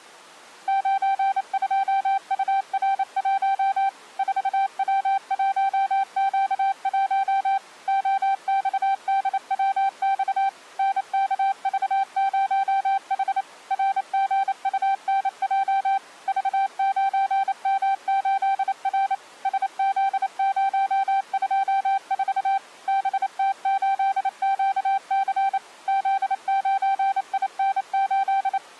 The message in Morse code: 92UR1 4W1Q1 OXDWX NKV0H RGUNJ V9M8R SZ024 BT8QC Z9IN8

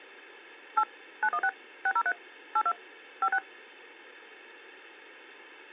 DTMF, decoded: 8 916 603 82 56

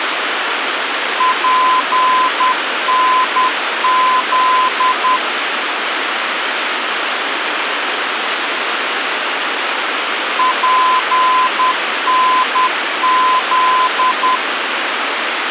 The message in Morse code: PNZ PNZ

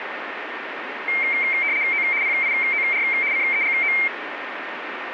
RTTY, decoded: O PIOR CEGO

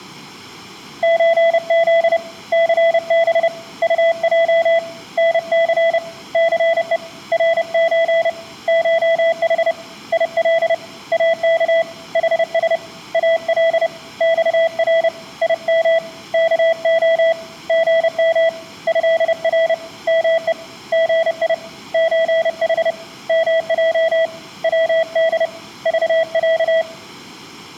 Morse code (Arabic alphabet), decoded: زذ ثب طج نث ثء رز شح يل اك حس ال صر يم كخ غم هر مء غي زح مج ود ضع

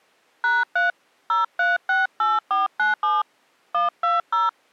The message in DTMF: #3 0368497 120

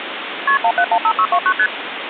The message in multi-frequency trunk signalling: KP 1715629 ST

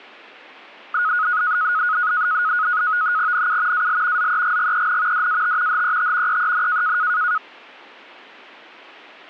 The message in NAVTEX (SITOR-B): NU AL ZEGGEN DAT HET EEN

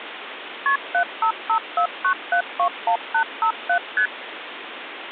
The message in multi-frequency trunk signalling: KP 75549721857 ST

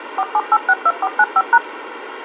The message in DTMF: 47862495#

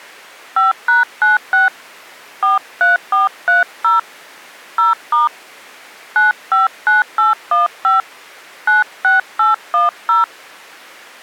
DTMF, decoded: 5#96 43430 0* 959815 96810

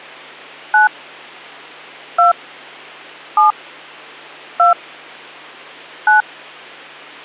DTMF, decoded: 9 2 7 2 9

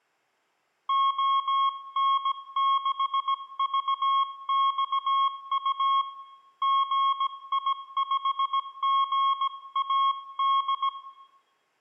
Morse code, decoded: ON6VXU GI5GAD

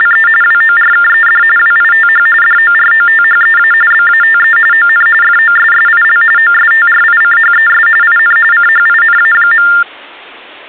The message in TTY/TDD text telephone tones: … WORKED WITH DOROTHEA BATE ON FOSSIL OSTRICHES IN CHINA.

